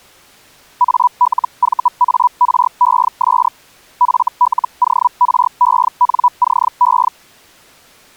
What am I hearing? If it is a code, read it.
Hellschreiber (Feld-Hell, 122.5 baud), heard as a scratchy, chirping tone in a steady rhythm, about 980 Hz. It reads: ALVARES FLORENCE